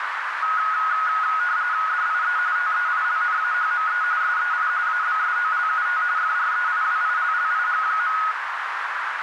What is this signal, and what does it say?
RTTY (45.45 baud, 170 Hz shift), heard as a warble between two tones, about 1360 Hz centre, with radio static and a narrow filter. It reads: DIE TEILNAHME SEI ABSOLUT FREIWILLIG.